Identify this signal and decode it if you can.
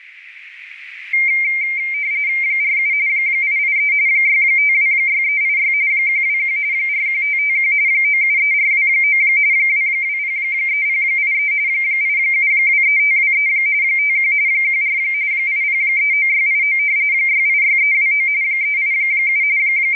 RTTY (45.45 baud, 170 Hz shift), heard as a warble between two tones, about 2200 Hz centre, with radio static. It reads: 47 883 6526386 121 41551 973429 2203083 8723523 51 14 8039689 686329 387 …